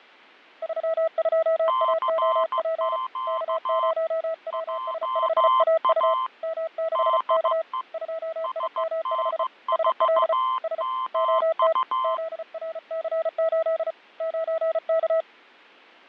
Morse code, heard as two keyed tones, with fading. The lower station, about 34 wpm, 650 Hz: 32AOP K0WS5AU M6K 2IM5 SL S OT ZRC8 9K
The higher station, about 15 wpm, 1040 Hz: CQ JA DE SN4MU